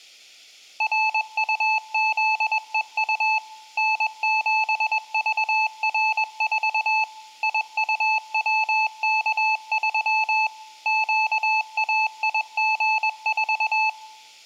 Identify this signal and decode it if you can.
Morse code, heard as a keyed tone, machine-sent, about 21 wpm, 870 Hz, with room echo. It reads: RUZEU N7VR4 IUWK3 QAIG4